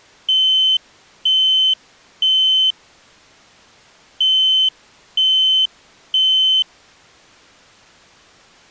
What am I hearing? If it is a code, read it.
Alarm pattern, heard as an alarm's beeps, played twice, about 3050 Hz. Temporal three. Smoke or fire, evacuate.